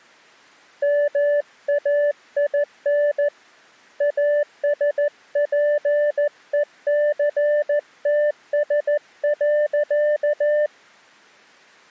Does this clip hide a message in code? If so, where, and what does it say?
Yes: Morse code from 0.8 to 10.7 s, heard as a keyed tone, hand-sent with a paddle, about 14 wpm, 590 Hz. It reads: MAIN ASPECTS.